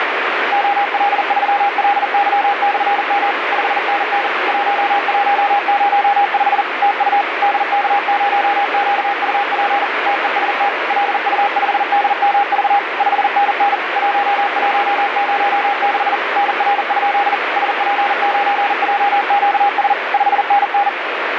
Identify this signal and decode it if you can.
Morse code, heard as a keyed tone, machine-sent, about 40 wpm, 810 Hz, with heavy radio static. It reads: OL3LY/M 5NN 1105 TU DK0QUP TEST LU5DMV 5NN 1106 NR? SP9JQS 5NN